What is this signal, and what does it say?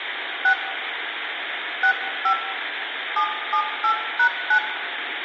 DTMF, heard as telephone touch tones, dialled by hand, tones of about 80 ms, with phone line noise and room echo. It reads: 6 65 778#9